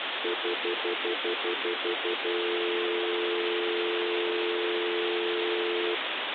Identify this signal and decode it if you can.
Telephone call progress tone (North American plan), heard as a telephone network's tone, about 350, 440 Hz, 0.1 s on and 0.1 s off, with phone line noise. Stutter dial tone.